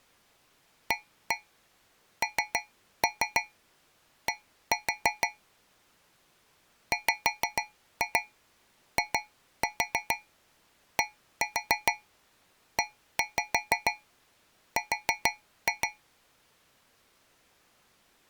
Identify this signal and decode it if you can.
Tap code, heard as taps on a metal pipe, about 6 knocks a second. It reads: AND WIDER